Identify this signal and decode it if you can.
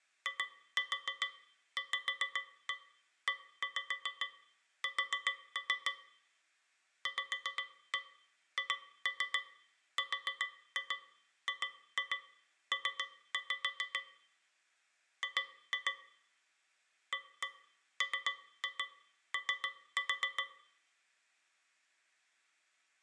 Tap code, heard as taps on a metal pipe, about 7 knocks a second, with room echo. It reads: IVES VHRGP G AMO